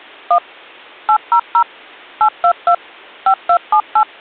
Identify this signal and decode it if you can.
DTMF, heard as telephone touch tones, dialled by machine, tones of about 80 ms. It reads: 1 800 822 5278